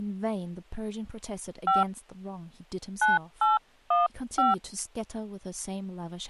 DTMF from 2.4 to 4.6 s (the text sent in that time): 9815